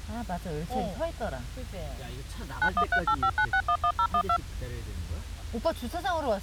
DTMF, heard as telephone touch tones, dialled by machine, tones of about 70 ms, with the noise inside a car. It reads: 913859611012